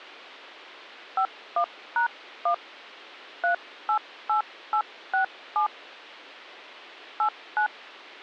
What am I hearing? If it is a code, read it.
DTMF, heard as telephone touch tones, dialled by hand, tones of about 100 ms. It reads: 51#1 388867 89